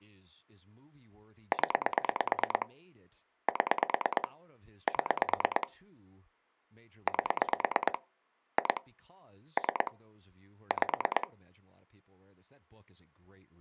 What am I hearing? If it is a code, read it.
Pulse dialling, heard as clicks on a phone line, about 9 pulses a second, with speech in English. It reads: 0 7 7 8 2 3 5